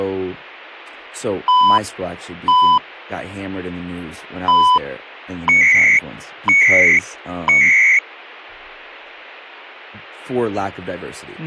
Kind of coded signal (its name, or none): radio time signal